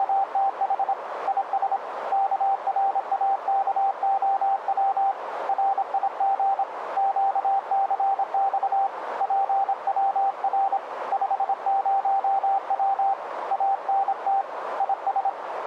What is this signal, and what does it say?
Morse code, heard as a keyed tone, hand-sent with a paddle, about 26 wpm, 780 Hz, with radio static and a narrow filter. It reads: … IS KRAKOW RIG QCX PWR 50W ANT IS